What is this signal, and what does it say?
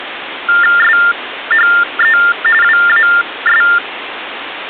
TTY/TDD text telephone tones (45.45 baud Baudot), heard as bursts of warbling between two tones, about 400 Hz shift, 1600 Hz centre, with phone line noise. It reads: SHE WAS